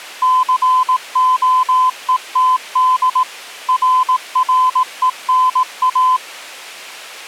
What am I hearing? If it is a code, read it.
Morse code, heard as a keyed tone, machine-sent, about 18 wpm, 1020 Hz. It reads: COETD RRENA